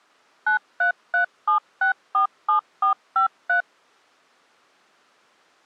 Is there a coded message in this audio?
Yes: DTMF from 0.5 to 3.6 s, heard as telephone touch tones, dialled by machine, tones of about 110 ms. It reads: 9337647453